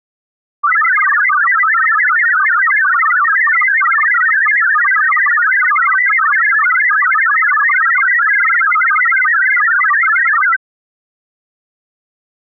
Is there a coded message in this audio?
Yes: multi-tone FSK (Olivia or MFSK type), about 1000 Hz wide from 0.6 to 10.6 s, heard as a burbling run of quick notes, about 62.5 baud.